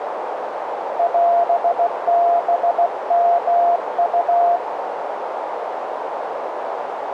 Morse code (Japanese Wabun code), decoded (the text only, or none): オハヨウ